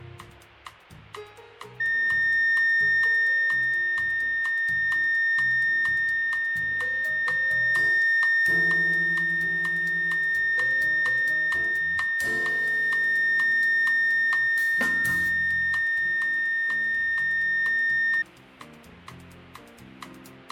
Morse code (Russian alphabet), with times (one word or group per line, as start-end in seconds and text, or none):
none